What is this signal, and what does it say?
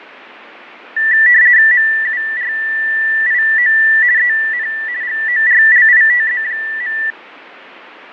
RTTY (50 baud, 170 Hz shift), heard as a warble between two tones, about 1850 Hz centre, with radio static and fading. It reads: MURIO EN GORLITZ.